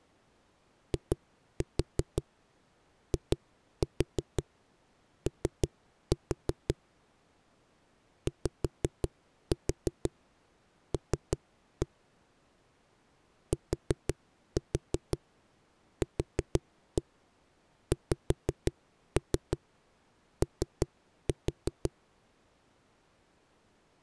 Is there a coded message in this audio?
Yes: tap code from 0.9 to 21.9 s, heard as knocks on a wall, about 5 knocks a second. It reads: IIO YL TQXO